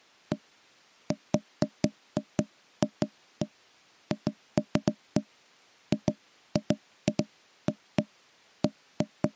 Irregular knocks on wood. There is no code.